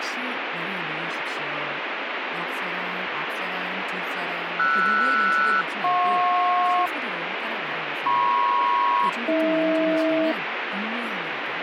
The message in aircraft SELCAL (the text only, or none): RS-JP MP-AH